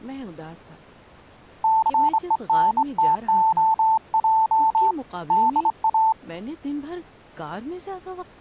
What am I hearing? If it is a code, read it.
Morse code, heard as a keyed tone, hand-sent with a straight key, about 25 wpm, 880 Hz, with speech in Urdu. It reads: CENTOJ DA